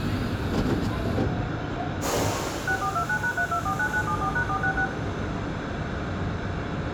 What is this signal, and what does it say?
DTMF, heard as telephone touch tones, dialled by machine, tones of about 80 ms, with radio hiss, room echo and the noise inside a subway train. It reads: 6429#3249974#466